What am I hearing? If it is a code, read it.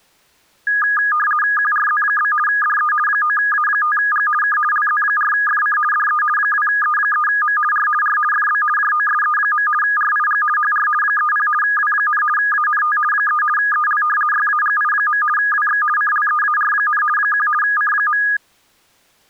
RTTY (50 baud, 450 Hz shift), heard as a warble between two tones, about 1440 Hz centre. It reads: QRZ? DE 9A5G K LZ4FC DE 2E3M R R FB JOSE. RIG HR 30 W, ANT 3 EL YAGI. WX CLEAR, 1 C.